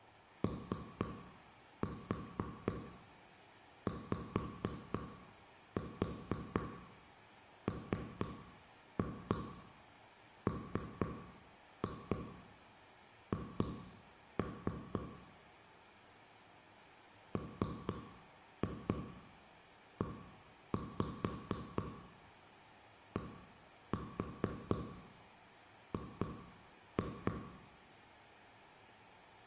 Tap code, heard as taps on a table, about 4 knocks a second, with room echo. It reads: OYMMH MEDG